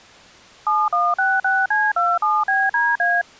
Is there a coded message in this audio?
Yes: DTMF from 0.7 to 3.2 s, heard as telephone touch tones, dialled by machine, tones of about 220 ms. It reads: 7166C27BDA